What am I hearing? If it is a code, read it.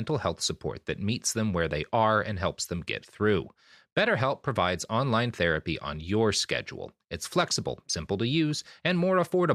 Speech in English. There is no code.